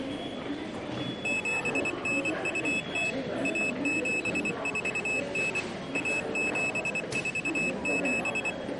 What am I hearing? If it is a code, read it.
Morse code (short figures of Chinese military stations), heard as a high beeper, machine-sent, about 24 wpm, 2600 Hz, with the noise of a subway station. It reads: 7920 1749 1747